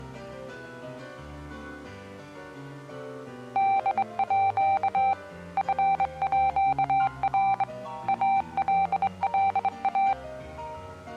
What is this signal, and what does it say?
Morse code (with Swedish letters), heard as a keyed tone, hand-sent with a straight key, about 23 wpm, 780 Hz. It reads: DÅ FÅR ALLA